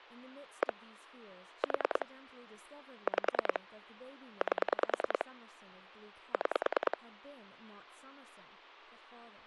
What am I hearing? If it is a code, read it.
Pulse dialling, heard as clicks on a phone line, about 10 pulses a second, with speech in English. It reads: 1 4 5 8 6